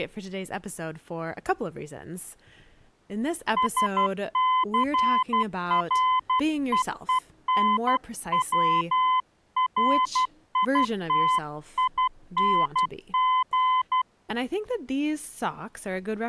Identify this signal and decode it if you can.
Morse code, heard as a keyed tone, hand-sent with a paddle, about 12 wpm, 1020 Hz, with speech in English. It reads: SCREENWRITING